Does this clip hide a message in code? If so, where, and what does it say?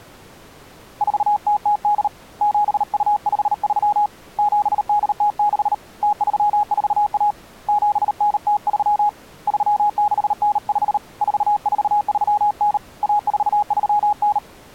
Yes: Morse code (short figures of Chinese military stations) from 1.0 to 14.4 s, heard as a keyed tone, hand-sent with a paddle, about 38 wpm, 830 Hz. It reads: 4008 7253 7806 0341 7903 3695 4439 1439